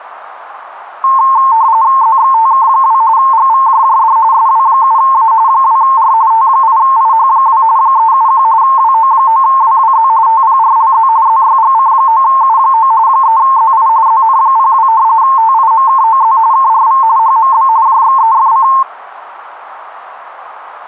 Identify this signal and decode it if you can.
RTTY (45.45 baud, 170 Hz shift), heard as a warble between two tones, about 980 Hz centre, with radio static. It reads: ZXTK2 GVJJD SW7A 2R T8IH2 371 WO9WWZ TPRLZ ZYGC9U9 3ZI ZN02 TIMKOZ KRV HMB JXEFC